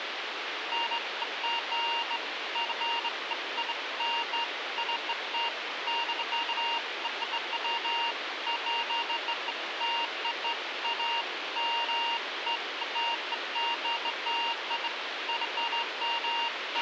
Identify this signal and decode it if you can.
Beeps of irregular length, with radio hiss and a squelch burst at the end. There is no code.